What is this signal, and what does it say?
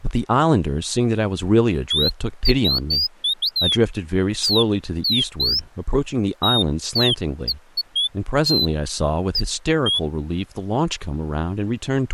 Bird-like chirps, with speech in English. There is no code.